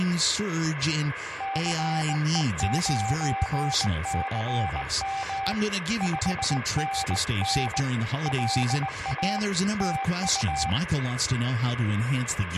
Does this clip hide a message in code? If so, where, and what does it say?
Yes: Morse code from 1.3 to 10.8 s, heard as a keyed tone, hand-sent with a bug key, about 19 wpm, 780 Hz, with radio static and room echo. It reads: CE9CM 5NN LA TU